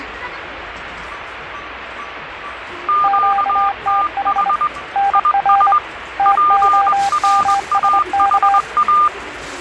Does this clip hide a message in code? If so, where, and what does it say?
Yes: Morse code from 2.8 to 9.1 s, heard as two keyed tones, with radio static and the noise of a crowd indoors. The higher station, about 21 wpm, 1200 Hz: QTH IS PRAHA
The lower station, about 25 wpm, 800 Hz: QTH NR TOMSK